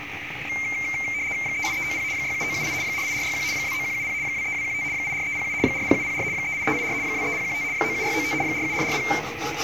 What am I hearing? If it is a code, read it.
RTTY (75 baud, 170 Hz shift), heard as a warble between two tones, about 2200 Hz centre, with radio static, a narrow filter and kitchen noise. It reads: 38390 67978 48461 29170 23215 84307 40704 38384 23015 97695 47440